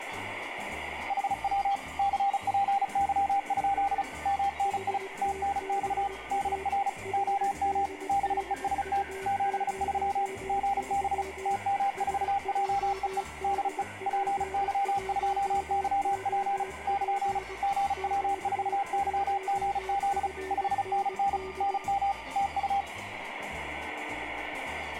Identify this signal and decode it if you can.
Morse code, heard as two keyed tones, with radio static. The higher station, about 35 wpm, 800 Hz: HW CPY? MNI TNX DR OM BEST 73 GB TM4JEE DE PY2YP <KN> GW4YGZ 5NN NM TU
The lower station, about 20 wpm, 380 Hz: HTBA HDDU03 SJDP1OP Q1FND